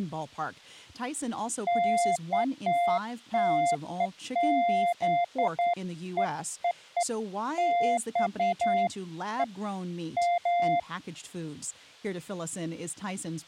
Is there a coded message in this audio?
No, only beeps of irregular length, with speech in English.